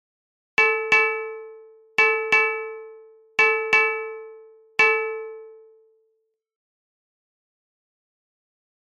Ship's bell, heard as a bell, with room echo. 7. Seven half-hours of the watch have passed.